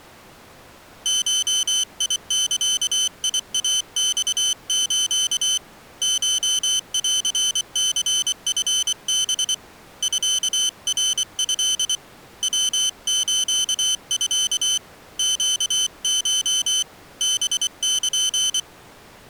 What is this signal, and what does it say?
Morse code (Japanese Wabun code), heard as a high beeper, hand-sent with a paddle, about 24 wpm, 3050 Hz. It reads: ゴザイマス コンニチハ ミナト ヤスミ ネコ ハル